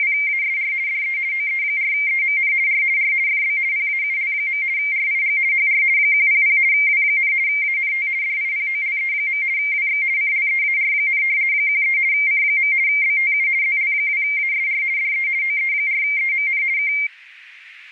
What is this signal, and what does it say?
RTTY (50 baud, 170 Hz shift), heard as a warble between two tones, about 2200 Hz centre, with radio static. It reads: … DE OE4EMN R R FB PAUL. RIG HR 100 W, ANT DIPOLE. WX CLEAR, 13 C. BTU ZL2ASR DE OE4EMN K